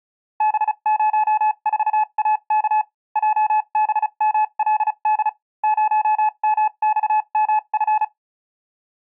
Morse code, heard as a keyed tone, machine-sent, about 35 wpm, spaced as for 30 wpm, 860 Hz. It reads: B04AK JBMLD 0MXMF